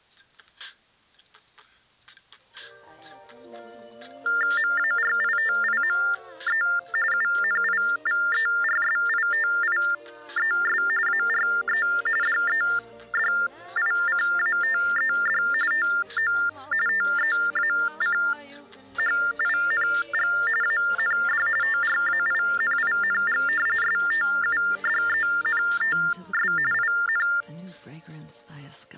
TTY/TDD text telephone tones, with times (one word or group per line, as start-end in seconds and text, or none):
4.6-6.6 MARITIME
7.1-10.8 UNIVERSITIES
11.1-11.9 ARE
12.2-15.4 DEDICATED
15.7-16.3 TO
16.9-20.3 TEACHING
20.6-21.5 AND
21.6-23.4 TRAINING
23.8-26.5 STUDENTS
26.7-27.3 IN